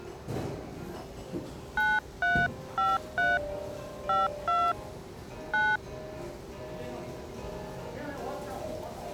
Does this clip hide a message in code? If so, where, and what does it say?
Yes: DTMF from 1.8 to 5.8 s, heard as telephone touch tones, dialled by hand, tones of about 220 ms, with the noise of a restaurant. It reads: 9353 52 9